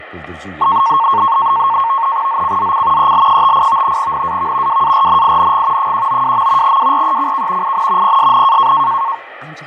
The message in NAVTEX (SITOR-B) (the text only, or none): ZCZC EL58 NAV WARNING 192. WRECK IN PSN